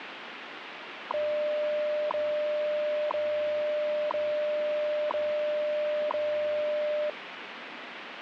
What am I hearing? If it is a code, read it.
Radio time signal (WWV, Colorado), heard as ticks, one a second, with radio static.